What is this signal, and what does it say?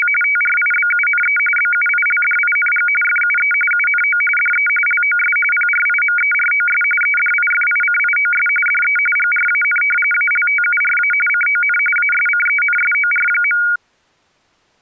RTTY (45.45 baud, 850 Hz shift), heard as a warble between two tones, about 1850 Hz centre. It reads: … TRIBUNE BUILDING FUE UNO DE LOS PRIMEROS EDIFICIOS DE GRAN ALTURA CON ASCENSOR.